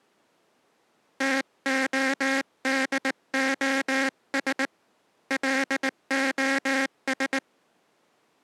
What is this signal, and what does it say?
Morse code, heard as a buzzer, hand-sent with a paddle, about 19 wpm. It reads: TODOS LOS